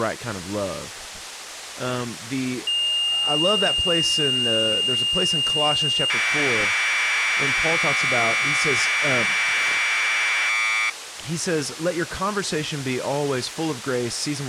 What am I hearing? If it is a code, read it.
Commodore tape loading (standard loader), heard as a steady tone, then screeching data, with speech in English.